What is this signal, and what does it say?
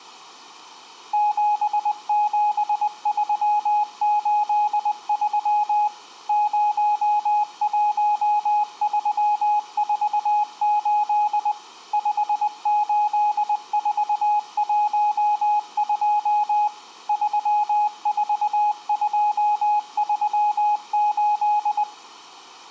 Morse code, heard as a keyed tone, machine-sent, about 20 wpm, 840 Hz. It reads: 77383 01348 58412 34238